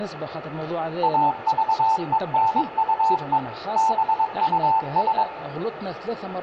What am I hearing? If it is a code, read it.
Morse code, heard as a keyed tone, machine-sent, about 22 wpm, 890 Hz, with room echo. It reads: AVENUE BUS